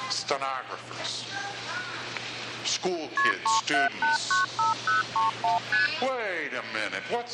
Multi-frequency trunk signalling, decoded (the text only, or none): KP 37895031 ST